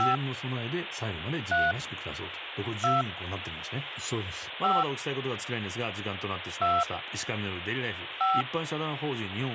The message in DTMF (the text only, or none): 5 3 2 5 2 5